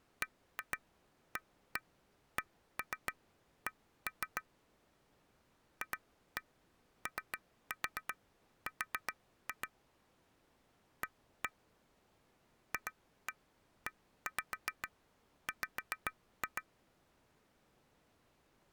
Tap code, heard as taps on glass, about 7 knocks a second. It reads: BACK FOR A FEW